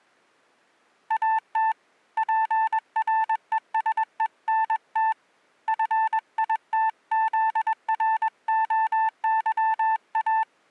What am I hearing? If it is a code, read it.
Morse code, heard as a keyed tone, hand-sent with a paddle, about 21 wpm, 880 Hz. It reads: AT PRESENT FITZROYA